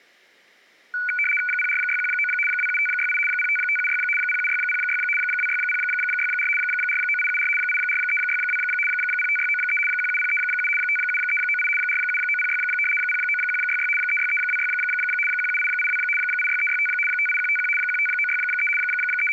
RTTY (75 baud, 850 Hz shift), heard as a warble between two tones, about 1900 Hz centre. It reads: 04619 27568 05576 07606 26064 49874 84362 05693 17037 57398 47906 09166 36326 17882 86365 58151 15963 …